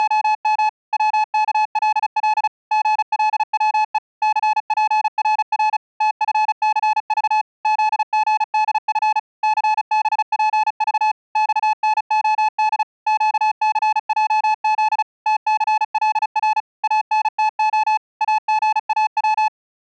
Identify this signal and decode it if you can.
Morse code, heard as a keyed tone, machine-sent, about 35 wpm, 860 Hz. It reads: … WKLL GLWE CPRR TFCV ZGDF CBPV XNOD QCJZ TCLR ANTO AGAW